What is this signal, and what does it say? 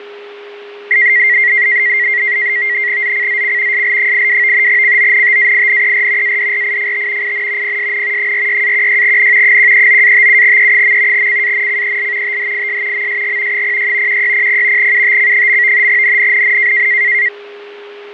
NAVTEX (SITOR-B), 100 baud, 170 Hz shift, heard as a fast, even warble, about 2000 Hz centre, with fading and a steady whistle near 410 Hz. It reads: ZCZC SL82 CONTAINER ADRIFT IN PSN 46-16N 139-57E. CANCEL THIS MSG 06 1600 UTC. NNNN